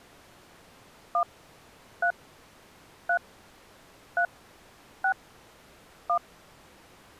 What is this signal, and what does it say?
DTMF, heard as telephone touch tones, dialled by hand, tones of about 80 ms. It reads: 1 3 3 3 6 1